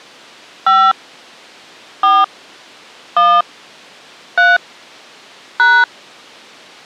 DTMF, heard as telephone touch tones, dialled by hand, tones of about 240 ms. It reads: 5 4 1 3 #